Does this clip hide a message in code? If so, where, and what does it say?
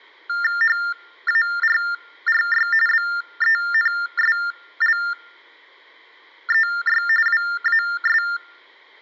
Yes: TTY/TDD text telephone tones (45.45 baud Baudot) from 0.3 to 8.4 s, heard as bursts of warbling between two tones, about 400 Hz shift, 1600 Hz centre. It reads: HARRY BENSLEY WAS